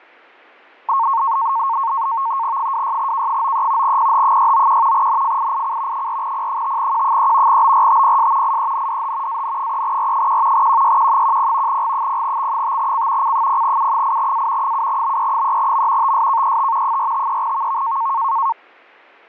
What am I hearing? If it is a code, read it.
NAVTEX (SITOR-B), 100 baud, 170 Hz shift, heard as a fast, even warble, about 1000 Hz centre, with fading. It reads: 26K93 PH691 NFIIC 4P5Q3 BRTPS IENDH AN3R1 QYQ10 G0X5C C0U8A 7BE3M TSKET 453VV